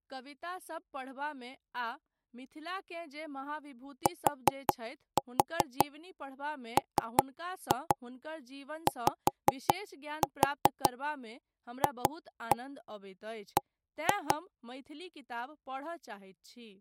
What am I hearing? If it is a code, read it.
Tap code, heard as knocks on wood, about 5 knocks a second, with speech in Maithili. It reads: TMYFB